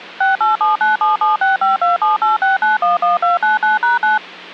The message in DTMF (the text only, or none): 687977652786911299#9